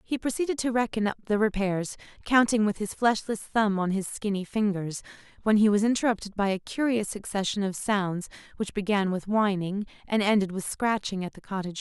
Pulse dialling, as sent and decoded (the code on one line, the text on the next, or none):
none